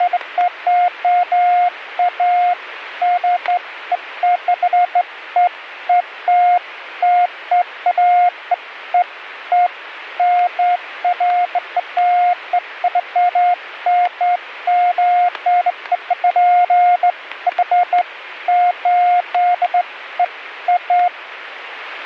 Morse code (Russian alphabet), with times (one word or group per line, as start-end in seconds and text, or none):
none